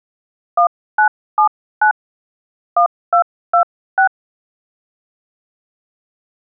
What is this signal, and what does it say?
DTMF, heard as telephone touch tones, dialled by hand, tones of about 100 ms. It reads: 1979 1226